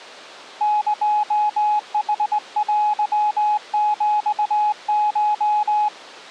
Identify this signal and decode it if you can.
Morse code (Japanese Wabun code), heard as a keyed tone, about 20 wpm, 840 Hz. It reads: エヌテヒコ